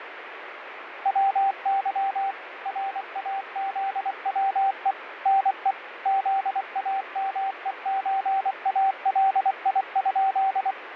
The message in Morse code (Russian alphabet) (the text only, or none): ВЫ РАЗВЕ НЕ ЗАМЕЧАЛИ?